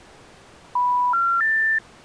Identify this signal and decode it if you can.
Telephone call progress tone (North American plan), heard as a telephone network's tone, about 980, 1370, 1800 Hz. Special information tone.